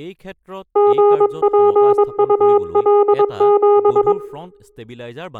Morse code, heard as a keyed tone, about 22 wpm, 410 Hz, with room echo and speech in Assamese. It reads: GPUL7